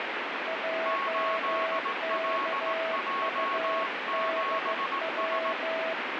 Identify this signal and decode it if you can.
Morse code, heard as two keyed tones, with heavy radio static. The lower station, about 15 wpm, 650 Hz: JKUDW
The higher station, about 18 wpm, 1100 Hz: 8LJ7S